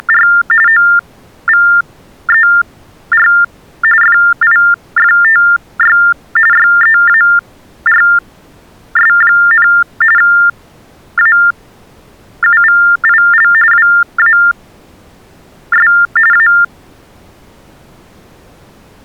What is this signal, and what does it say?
TTY/TDD text telephone tones (45.45 baud Baudot), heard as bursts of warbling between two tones, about 400 Hz shift, 1600 Hz centre. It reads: … OVER FIFTY YEARS, AUVIL WAS A